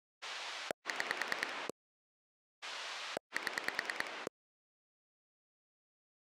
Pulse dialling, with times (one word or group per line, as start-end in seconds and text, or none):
0.2-1.7 6
2.6-4.3 7